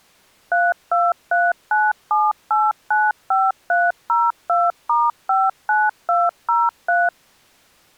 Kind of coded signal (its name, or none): DTMF